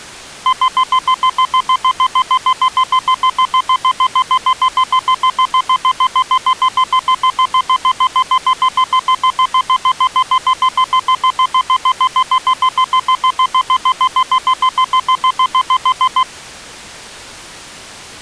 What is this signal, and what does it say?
Evenly repeated beeps. There is no code.